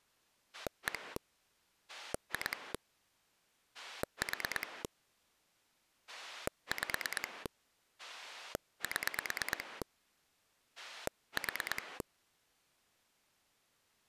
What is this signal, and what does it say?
Pulse dialling, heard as a rotary dial, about 9 pulses a second. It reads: 1 2 4 5 7 4